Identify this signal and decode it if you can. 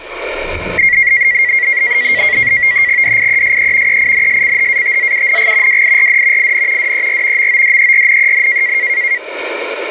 NAVTEX (SITOR-B), 100 baud, 170 Hz shift, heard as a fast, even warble, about 2050 Hz centre, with the noise inside a lift. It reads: DIESE EINSCHATZUNG WIRD IN DER MODERNEN